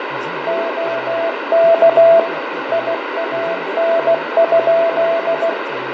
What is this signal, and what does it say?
Morse code, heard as a keyed tone, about 16 wpm, 670 Hz, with radio static, fading, room echo and speech in Sindhi. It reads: OK IAN?